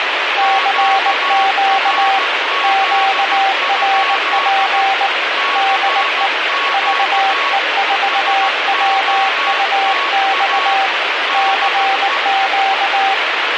Morse code, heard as two keyed tones, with heavy radio static. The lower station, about 19 wpm, 780 Hz: CQ QRP DE VE4WUX CQ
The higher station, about 15 wpm, 1110 Hz: QRZ? CQ SOTA DE